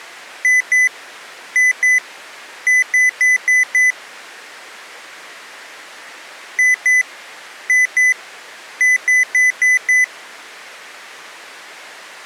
Beep code, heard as beeps from a small speaker, played twice, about 2000 Hz. 2-2-5.